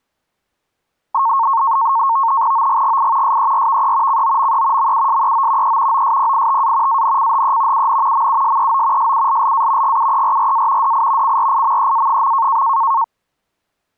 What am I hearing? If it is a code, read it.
NAVTEX (SITOR-B), 100 baud, 170 Hz shift, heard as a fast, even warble, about 1000 Hz centre. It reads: OGGI SERVE COME MUSEO E OSPITA ANCHE UN MUSEO SULLA GUERRA DI CRIMEA.